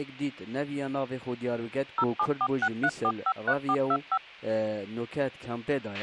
DTMF, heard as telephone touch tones, dialled by machine, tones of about 60 ms, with a squelch burst at the end. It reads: 07463453425